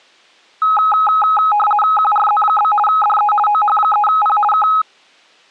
RTTY (50 baud, 450 Hz shift), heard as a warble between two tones, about 1060 Hz centre. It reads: QRZ? DE OH3P K